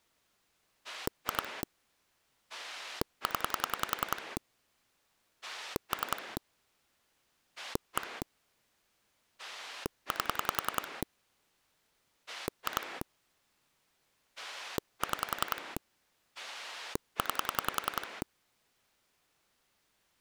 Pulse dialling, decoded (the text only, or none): 2 0 3 1 8 2 6 9